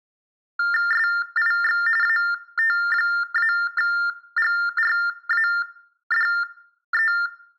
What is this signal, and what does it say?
TTY/TDD text telephone tones (45.45 baud Baudot), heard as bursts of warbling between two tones, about 400 Hz shift, 1600 Hz centre. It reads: SIX AT-GRADE